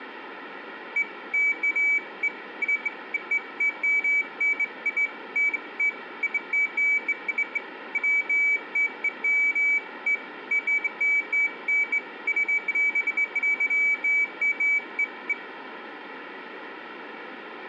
Beeps of irregular length, with room echo. There is no code.